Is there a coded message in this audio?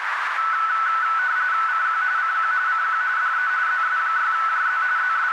Yes: RTTY (45.45 baud, 170 Hz shift) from 0.4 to 5.3 s, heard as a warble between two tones, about 1400 Hz centre, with radio static and a narrow filter. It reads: CQ CQ CQ DE ZS6JZ …